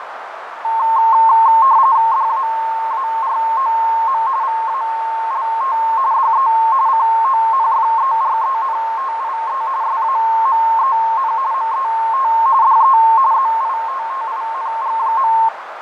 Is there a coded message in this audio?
Yes: RTTY (45.45 baud, 170 Hz shift) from 0.6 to 15.5 s, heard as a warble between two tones, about 980 Hz centre, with radio static, fading and a narrow filter. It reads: DAAROM VALT DE CONFERENTIE SAMEN MET DE ZITTING.